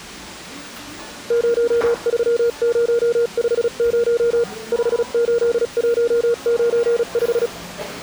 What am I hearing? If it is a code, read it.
Morse code, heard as a keyed tone, machine-sent, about 36 wpm, spaced as for 33 wpm, 470 Hz, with the noise of a cafe. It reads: 03050 58195